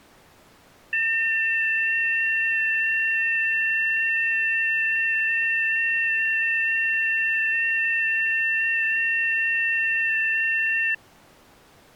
FT8 (several signals at once), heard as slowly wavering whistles, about 6.25 baud.